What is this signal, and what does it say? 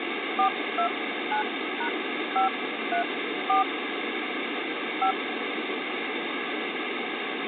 DTMF, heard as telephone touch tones, dialled by hand, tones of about 100 ms, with phone line noise. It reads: 429#534 5